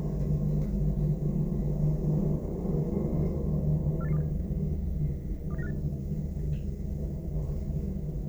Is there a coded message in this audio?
Yes: five-tone selective call (EEA) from 4.0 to 5.7 s, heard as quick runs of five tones, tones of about 40 ms, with the noise inside a lift. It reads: 48827 27958